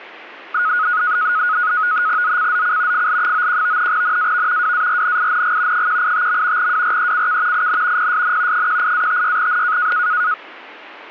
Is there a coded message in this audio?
Yes: NAVTEX (SITOR-B), 100 baud, 170 Hz shift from 0.5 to 10.3 s, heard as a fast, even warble, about 1360 Hz centre, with static crashes. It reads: ZCZC FL91 NAV WARNING 185. WRECK IN PSN 18-56N